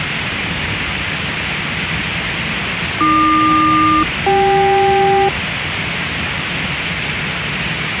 Aircraft SELCAL, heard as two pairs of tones, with radio hiss and the noise inside a subway train. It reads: AQ-CK